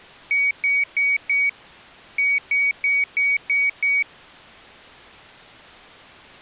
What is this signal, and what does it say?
Beep code, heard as a piezo beeper, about 2250 Hz. 4-6.